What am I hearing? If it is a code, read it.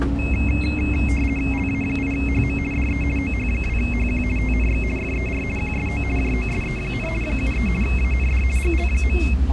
RTTY (50 baud, 450 Hz shift), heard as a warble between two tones, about 2350 Hz centre, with static crashes and the noise inside a bus. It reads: LA8HM DE OH2HQ TNX FER QSO JOSE, 73 AND GL.